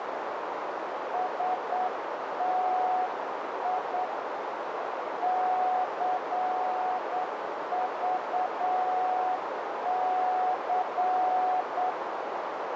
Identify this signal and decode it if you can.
Morse code, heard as a keyed tone, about 8 wpm, 740 Hz, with heavy radio static and a narrow filter. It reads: STI CVC